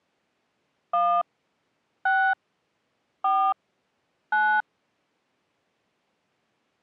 DTMF, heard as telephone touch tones, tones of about 280 ms. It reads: 1 6 4 9